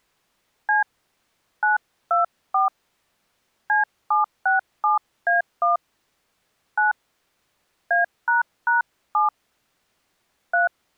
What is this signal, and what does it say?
DTMF, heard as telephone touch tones, dialled by hand, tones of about 140 ms. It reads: C 924 C767A1 9 A##7 3